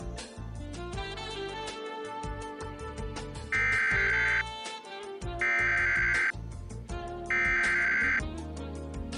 Emergency Alert System (SAME) tones (header bursts), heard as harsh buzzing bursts, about 520.83 baud.